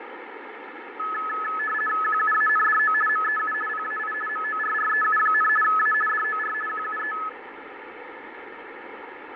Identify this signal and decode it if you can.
RTTY (50 baud, 450 Hz shift), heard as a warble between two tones, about 1500 Hz centre, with radio static and fading. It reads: QUANDO MEU PAI MORREU, A DOR QUE